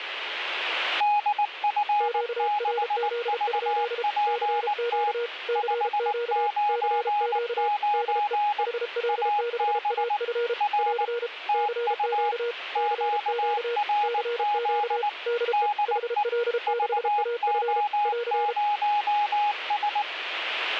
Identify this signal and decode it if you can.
Morse code, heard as two keyed tones, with radio static. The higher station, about 19 wpm, 830 Hz: DF6VPT 599 AB R TU QRZ DE VO0S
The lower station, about 33 wpm, 470 Hz: QRZ? CQ CQ CQ DE HL6AF <AR> CQ CQ CQ DE HL6AF <AR>